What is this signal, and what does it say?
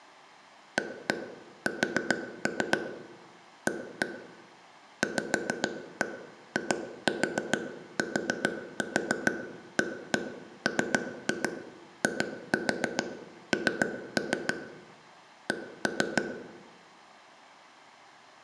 Tap code, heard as taps on a table, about 6 knocks a second, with room echo. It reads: AS A VITAMIN C